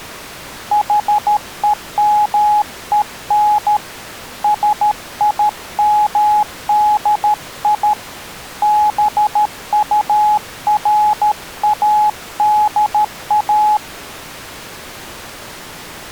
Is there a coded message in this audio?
Yes: Morse code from 0.7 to 13.8 s, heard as a keyed tone, hand-sent with a paddle, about 13 wpm, 840 Hz. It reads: HEMEN SIMDI BURADA